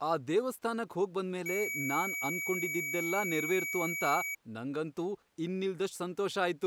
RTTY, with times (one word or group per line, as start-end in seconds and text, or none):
none